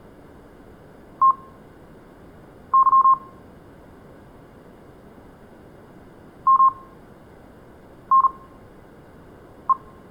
Morse code (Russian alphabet), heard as a keyed tone, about 39 wpm, spaced as for 6 wpm, 1060 Hz, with room echo. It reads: ТЫ МНЕ